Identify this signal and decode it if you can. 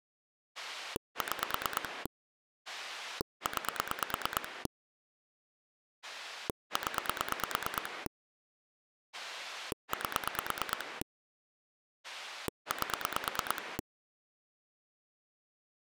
Pulse dialling, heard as a rotary dial, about 9 pulses a second. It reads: 6 9 0 8 8